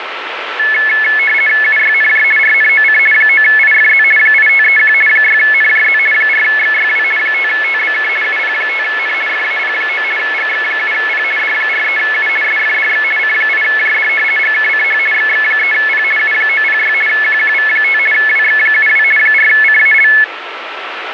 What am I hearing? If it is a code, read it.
RTTY (50 baud, 450 Hz shift), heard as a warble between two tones, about 1950 Hz centre, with radio static. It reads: UYNJ RNOC 9IFZ 8531 6NJZ 4XYW 5TBK UP5N FAP9 GX7P D43U SFDX C8JD GKCH XX3P U906 QQV5 WX72 4CAL